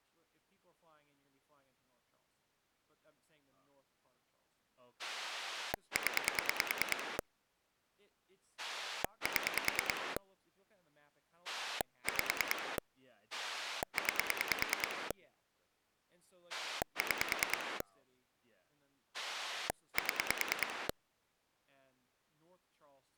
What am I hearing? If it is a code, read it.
Pulse dialling, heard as a rotary dial, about 9 pulses a second, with speech in English. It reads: 0 7 5 9 6 7